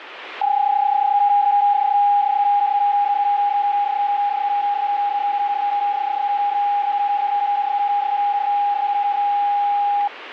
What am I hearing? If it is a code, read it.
PSK31 (31.25 baud), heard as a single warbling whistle, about 820 Hz, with radio static.